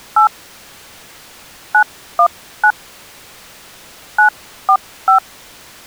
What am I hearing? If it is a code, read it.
DTMF, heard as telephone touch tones, dialled by hand, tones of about 90 ms. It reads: 8 919 945